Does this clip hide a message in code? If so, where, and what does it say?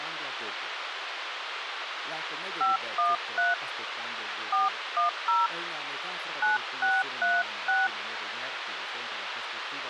Yes: DTMF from 2.6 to 7.9 s, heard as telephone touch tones, dialled by hand, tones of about 170 ms, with radio hiss and speech in Italian. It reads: 513 410 9636